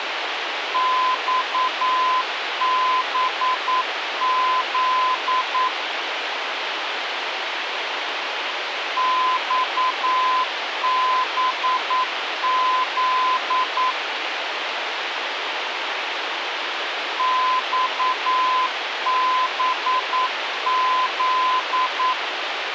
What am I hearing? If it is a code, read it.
Morse code, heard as a keyed tone, machine-sent, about 9 wpm, 1020 Hz, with radio hiss. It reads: XBZ XBZ XBZ